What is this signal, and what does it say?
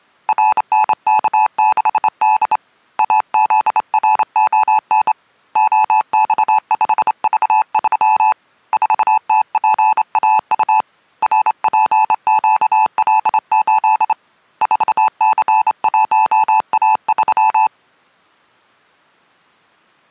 Morse code, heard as a keyed tone, hand-sent with a straight key, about 27 wpm, 870 Hz. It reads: RNK6D AZRON OX5V3 4TPAU RPQL8 4C1A3